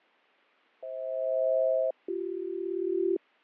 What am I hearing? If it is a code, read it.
Aircraft SELCAL, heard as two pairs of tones, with fading. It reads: FH-BC